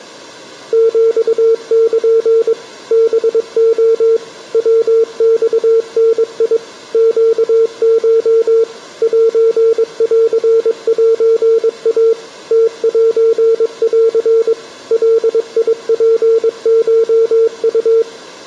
Morse code (Japanese Wabun code), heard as a keyed tone, machine-sent, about 22 wpm, 450 Hz. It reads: ヒル ハレ ヤマダ ネコ センセイ ムセン ガツコウ